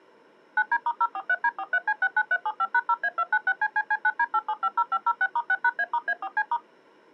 DTMF, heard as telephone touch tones, dialled by machine, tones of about 50 ms. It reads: 9D*043D43C69375#0A296CCC9D8750506*6#A*A4C*